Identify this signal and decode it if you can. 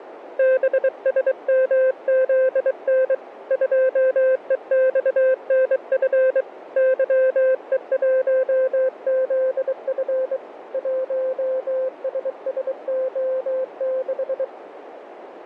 Morse code, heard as a keyed tone, hand-sent with a bug key, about 23 wpm, 520 Hz, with radio static, fading and a narrow filter. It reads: BSMZN 2EXNF YE1ZF 1SSO6